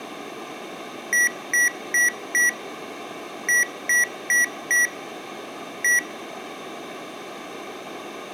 Beep code, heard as beeps from a small speaker, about 1950 Hz, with room echo. 4-4-1. In Phoenix BIOS tables: serial port failure.